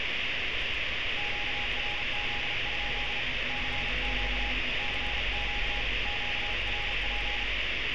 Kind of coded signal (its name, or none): Morse code